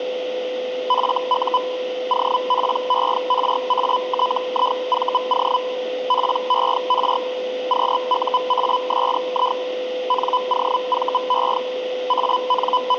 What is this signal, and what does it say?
Hellschreiber (Feld-Hell, 122.5 baud), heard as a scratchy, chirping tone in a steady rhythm, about 1000 Hz, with a steady whistle near 510 Hz. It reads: FU OPERATIVO PER QUASI NOVE …